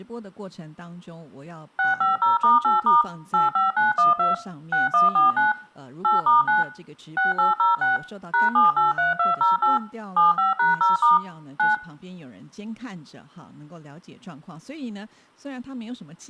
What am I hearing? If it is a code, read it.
DTMF, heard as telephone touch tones, dialled by machine, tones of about 150 ms, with room echo and speech in Chinese. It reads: 650*8* 85912 6149 8*9 6806 #783208 75#0* 9